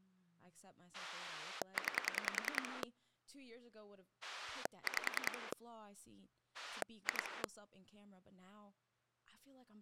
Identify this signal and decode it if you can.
Pulse dialling, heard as a rotary dial, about 10 pulses a second, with speech in English. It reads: 9 5 2